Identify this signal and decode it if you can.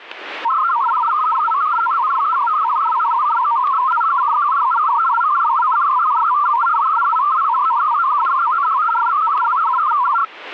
Multi-tone FSK (Olivia or MFSK type), about 500 Hz wide, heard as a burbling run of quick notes, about 62.5 baud, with static crashes.